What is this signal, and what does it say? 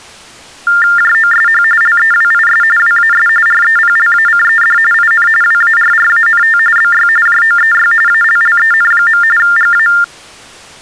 TTY/TDD text telephone tones (45.45 baud Baudot), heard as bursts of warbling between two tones, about 400 Hz shift, 1600 Hz centre. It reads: JOSH LEWIS WAS REPLACED IN WARRANT BY JOEY ALLEN. GA